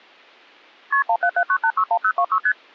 Multi-frequency trunk signalling (R1, as on North American trunks), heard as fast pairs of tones, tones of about 70 ms. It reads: KP 1779861026 ST